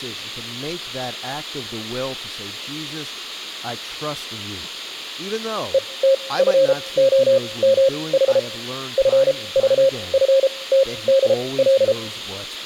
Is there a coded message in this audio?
Yes: Morse code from 5.7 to 12.0 s, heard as a keyed tone, machine-sent, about 33 wpm, spaced as for 22 wpm, 540 Hz, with speech in English. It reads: ETFOMH FVFTDL